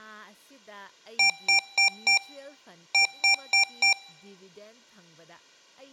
Beep code, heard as beeps from a small speaker, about 790 Hz, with room echo and speech in Manipuri. 4-4.